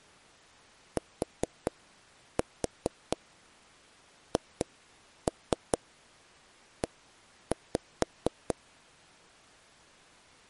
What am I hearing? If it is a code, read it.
Tap code, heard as taps on a table, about 4 knocks a second. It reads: THE